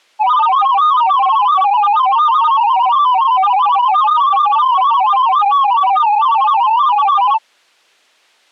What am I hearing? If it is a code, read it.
Multi-tone FSK (Olivia or MFSK type), about 500 Hz wide, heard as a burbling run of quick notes, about 31.25 baud.